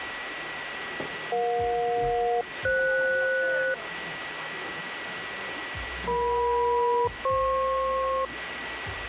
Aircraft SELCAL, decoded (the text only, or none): EJ-FS EM-FP